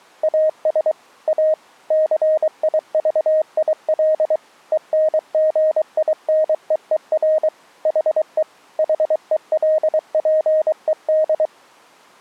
Morse code, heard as a keyed tone, machine-sent, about 23 wpm, 620 Hz. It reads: AS A CIVIL ENGINEER HE HELPED